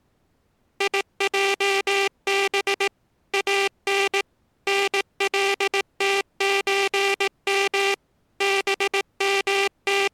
Morse code (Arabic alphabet), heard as a buzzer, machine-sent, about 18 wpm. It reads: يجب ان نلتزم …